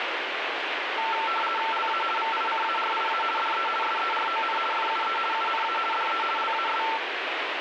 RTTY (50 baud, 450 Hz shift), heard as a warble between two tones, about 1120 Hz centre, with radio static. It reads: LA VICARIA DE SERON FUE UNA DE LAS